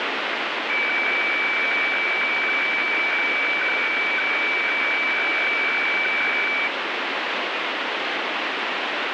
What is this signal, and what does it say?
Weather fax (radiofax), 120 lines a minute, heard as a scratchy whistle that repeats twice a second, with heavy radio static.